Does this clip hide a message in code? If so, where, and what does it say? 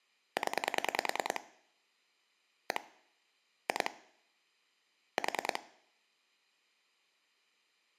Yes: pulse dialling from 0.4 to 5.6 s, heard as clicks on a phone line, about 10 pulses a second. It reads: 0 1 2 4